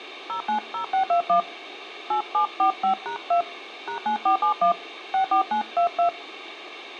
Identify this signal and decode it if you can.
DTMF, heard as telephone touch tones, dialled by hand, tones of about 100 ms, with radio hiss and room echo. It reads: 090621 8745#2 #9471 64922